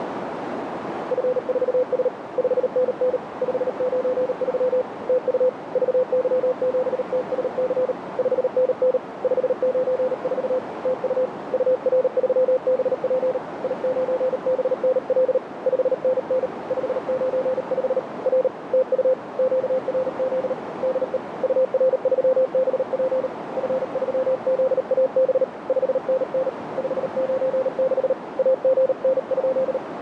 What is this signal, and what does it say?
Morse code, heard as a keyed tone, hand-sent with a paddle, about 38 wpm, 520 Hz, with radio static and a narrow filter. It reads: F4S 5NN 593 TU VY7TSC 5NN 594 TU UR3BP I9BNL 5NN 595 R TU QRZ DE UR3BP F3ZAB 5NN 596 AGN?